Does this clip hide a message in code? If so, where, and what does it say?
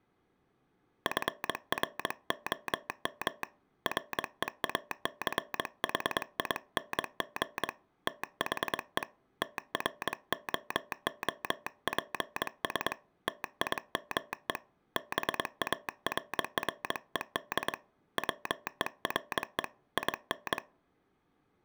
Yes: Morse code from 1.0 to 20.6 s, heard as a telegraph sounder, hand-sent with a paddle, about 22 wpm. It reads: FROM REACHING THE TROOPS TIME BARRED WERE IN